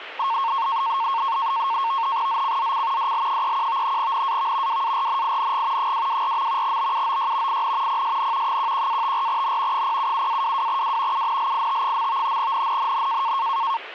NAVTEX (SITOR-B), 100 baud, 170 Hz shift, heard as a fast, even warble, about 1000 Hz centre. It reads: ZCZC DL31 NAV WARNING 224. BUOY IN PSN 11-54N 077-22W UNLIT. NNNN